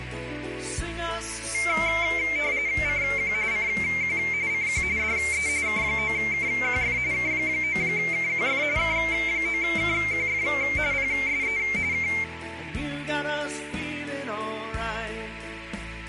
RTTY (45.45 baud, 170 Hz shift), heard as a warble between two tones, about 2200 Hz centre, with radio static and a narrow filter. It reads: CQ CQ CQ DE K9KQF K9KQF K9KQF PSE K